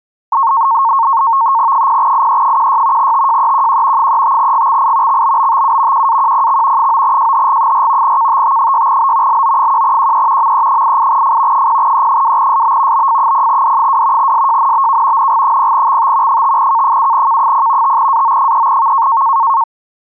NAVTEX (SITOR-B), 100 baud, 170 Hz shift, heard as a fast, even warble, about 1000 Hz centre. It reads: 0IE16 TJEQQ 35GXI XBBTU QAQPX 9JHG4 KTT6B LO1QE ME88F 0E2SB BF0D2 SJNBK NG0XT 5K7K0 5AO3V